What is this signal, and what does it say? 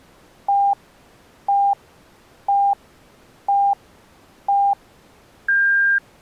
Radio time signal (five pips and a higher one, as on Chinese radio), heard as pips.